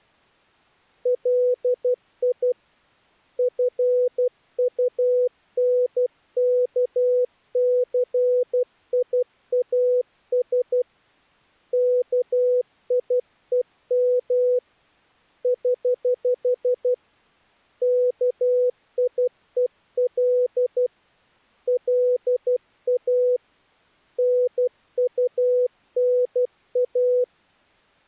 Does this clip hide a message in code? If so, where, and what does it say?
Yes: Morse code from 1.0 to 27.3 s, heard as a keyed tone, hand-sent with a paddle, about 12 wpm, 500 Hz. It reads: LI FUNKCIAS KIEM <HH> KIEL LA NUNA